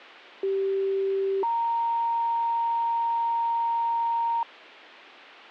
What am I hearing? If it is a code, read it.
Two-tone page, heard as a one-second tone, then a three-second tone, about 390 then 930 Hz, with a squelch burst at the end.